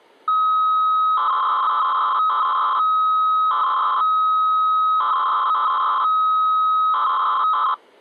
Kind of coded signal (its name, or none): 300-baud modem data